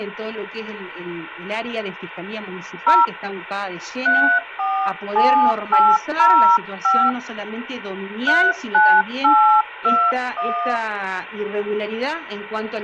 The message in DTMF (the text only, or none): 0 347805 39821